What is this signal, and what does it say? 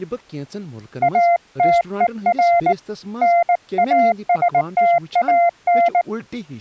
Morse code, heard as a keyed tone, hand-sent with a paddle, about 19 wpm, 690 Hz, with speech in Kashmiri. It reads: ATER NASTAN